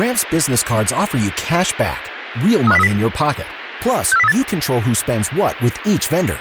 Five-tone selective call (EEA), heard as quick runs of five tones, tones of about 40 ms, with radio hiss and speech in English. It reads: 35030 64038